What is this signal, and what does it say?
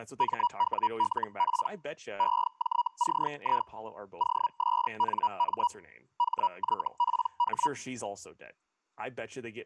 Hellschreiber (Feld-Hell, 122.5 baud), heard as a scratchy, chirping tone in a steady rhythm, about 960 Hz, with speech in English. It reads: MWLP EJCI OSNM HYPH